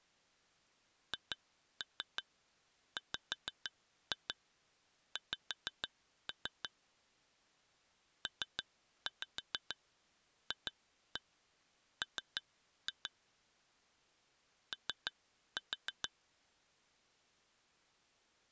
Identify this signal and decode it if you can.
Tap code, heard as taps on glass, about 6 knocks a second. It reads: HWX PFM O